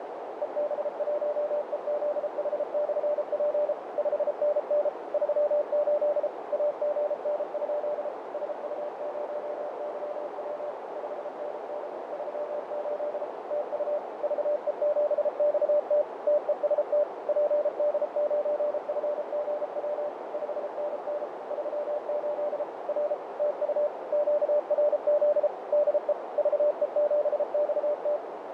Morse code, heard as a keyed tone, machine-sent, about 33 wpm, 590 Hz, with heavy radio static, fading and a narrow filter. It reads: EB1EZH/P 5NN 38 AGN? SU0YW 5NN 38 TU VE7XT TEST PD9FGW 5NN 38 R TU QRZ DE VE7XT